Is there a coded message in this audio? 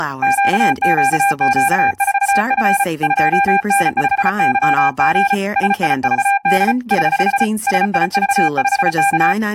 Yes: Morse code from 0.2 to 9.4 s, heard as a keyed tone, hand-sent with a paddle, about 34 wpm, 800 Hz, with speech in English. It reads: QQQ4F 2N5YG SIVD <HH> SIV5K